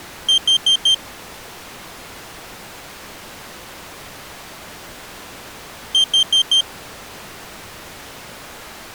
Alarm pattern, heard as an alarm's beeps, played twice, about 3150 Hz. Temporal four. Carbon monoxide.